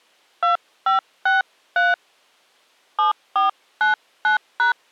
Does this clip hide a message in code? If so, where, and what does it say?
Yes: DTMF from 0.4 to 4.7 s, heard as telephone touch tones, dialled by hand, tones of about 150 ms. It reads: 2563 7499#